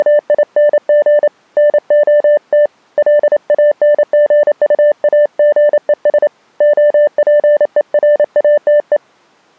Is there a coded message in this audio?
Yes: Morse code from 0.0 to 9.0 s, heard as a keyed tone, hand-sent with a paddle, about 28 wpm, 590 Hz. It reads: … NOT LANGUAGES OPERATE